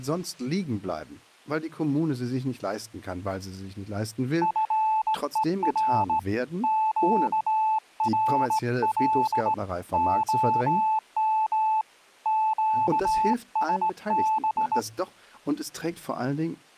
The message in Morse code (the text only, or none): FER QRL OM QSB